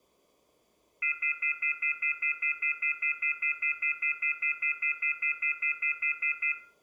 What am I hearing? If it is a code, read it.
Telephone call progress tone (North American plan), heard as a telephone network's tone, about 1400, 2050, 2450, 2600 Hz, 0.1 s on and 0.1 s off, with room echo. Off-hook warning tone.